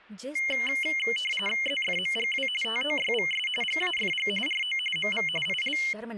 RTTY (45.45 baud, 850 Hz shift), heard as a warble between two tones, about 2550 Hz centre, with speech in Hindi. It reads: ZFMGW TOYVS GAFG RO MV IL